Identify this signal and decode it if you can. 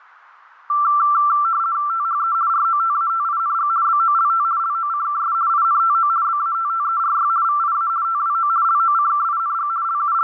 RTTY (50 baud, 170 Hz shift), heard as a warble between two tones, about 1260 Hz centre. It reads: THE ROTATING BOLT LOCKS INTO BATTERY VIA TWO LOCKING …